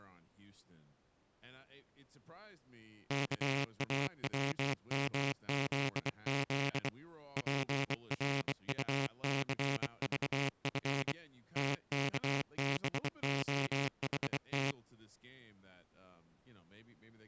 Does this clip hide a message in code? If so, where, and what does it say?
Yes: Morse code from 3.0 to 14.8 s, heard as a buzzer, hand-sent with a bug key, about 24 wpm, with speech in English. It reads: KAWMZZ PRUCVF TKBOHT